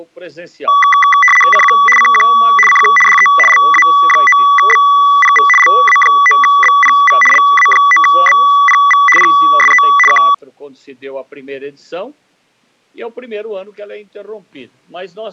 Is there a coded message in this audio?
Yes: RTTY (75 baud, 850 Hz shift) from 0.7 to 10.3 s, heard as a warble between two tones, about 1550 Hz centre. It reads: CQ CQ CQ DE LA9BPV LA9BPV LA9BPV PSE K